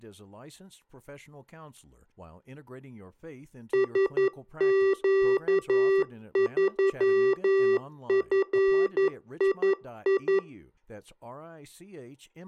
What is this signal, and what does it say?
Morse code, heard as electronic beeps, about 11 wpm, 390 Hz, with speech in English. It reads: SQ3FII